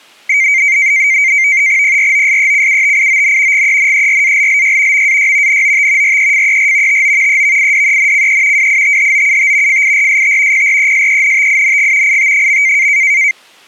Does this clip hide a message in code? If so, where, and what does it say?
Yes: NAVTEX (SITOR-B), 100 baud, 170 Hz shift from 0.3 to 13.3 s, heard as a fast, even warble, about 2200 Hz centre. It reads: PROSECUTION GENERALLY MAY NOT REFER TO EVIDENCE WITHOUT FIRST PRESENTING IT.